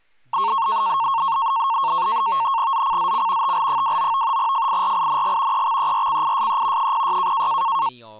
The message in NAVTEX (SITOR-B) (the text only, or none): ZCZC TL29 FIRING EXERCISE 06